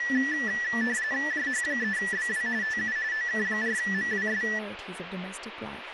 RTTY (45.45 baud, 170 Hz shift), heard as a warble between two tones, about 1850 Hz centre, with radio static and speech in English. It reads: JH3BW TU OK4MWS